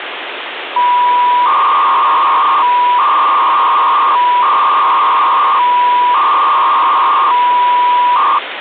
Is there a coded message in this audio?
Yes: 300-baud modem data (V.21 tones) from 0.8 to 8.4 s, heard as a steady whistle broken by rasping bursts, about 300 baud, 200 Hz shift, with phone line noise.